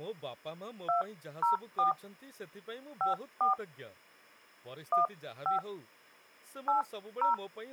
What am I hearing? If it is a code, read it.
DTMF, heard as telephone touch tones, dialled by hand, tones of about 130 ms, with speech in Odia. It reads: 204 54 15 80